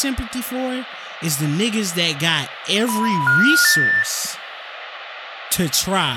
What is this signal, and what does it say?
Telephone call progress tone (North American plan), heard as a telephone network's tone, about 980, 1430, 1800 Hz, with phone line noise and speech in English. Special information tone.